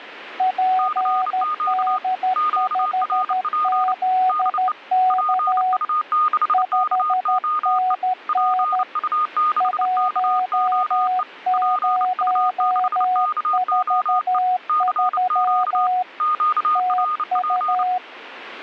Morse code, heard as two keyed tones. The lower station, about 13 wpm, 740 Hz: PD5ZK 5NN 1043 TU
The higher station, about 29 wpm, 1230 Hz: CQ QRP DE PU6KOE PU6KOE PU6KOE CQ QRP